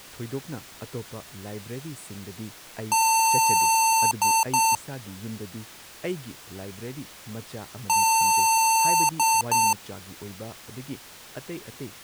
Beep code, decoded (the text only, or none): 1 long, 2 short